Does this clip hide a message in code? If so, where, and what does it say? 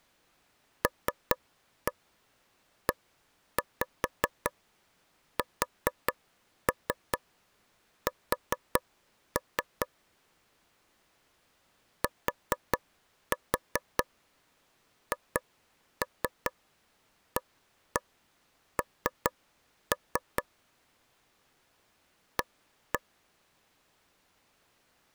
Yes: tap code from 0.8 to 23.0 s, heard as taps on a table, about 4 knocks a second. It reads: LESS THAN A